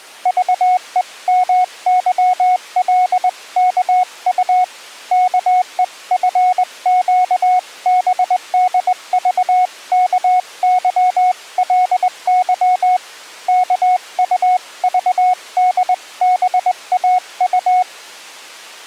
Morse code (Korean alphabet), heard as a keyed tone, hand-sent with a straight key, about 20 wpm, 730 Hz. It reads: 라멕이 아내들에게 이르되